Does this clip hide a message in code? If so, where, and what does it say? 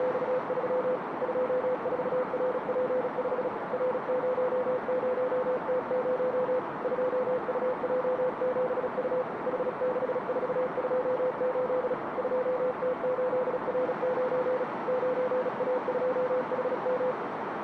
Yes: Morse code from 0.0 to 17.2 s, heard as a keyed tone, hand-sent with a paddle, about 36 wpm, 510 Hz, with radio static and a narrow filter. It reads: … 24RP5 R00T0 2UJ7U H6428 2T8R9 9A2HM